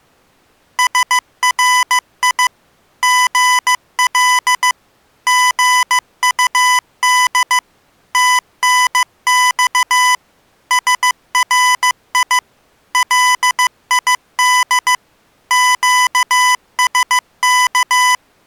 Morse code, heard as electronic beeps, machine-sent, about 15 wpm, 1000 Hz. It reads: SRI GL GUD TNX SRI LID QSK